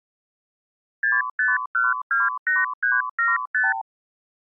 Multi-frequency trunk signalling (R2, with the far end's replies), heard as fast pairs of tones, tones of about 180 ms. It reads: 65128375